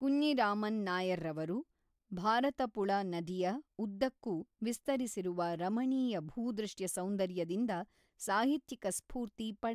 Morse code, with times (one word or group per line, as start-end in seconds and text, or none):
none